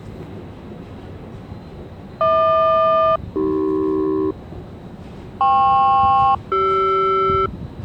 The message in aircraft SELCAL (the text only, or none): HQ-AC KP-CR